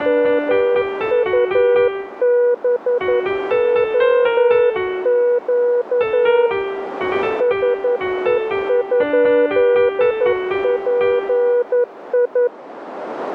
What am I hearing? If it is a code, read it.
Morse code, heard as a keyed tone, hand-sent with a paddle, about 11 wpm, 490 Hz, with radio static and a narrow filter. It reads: MUBOQ SE?PI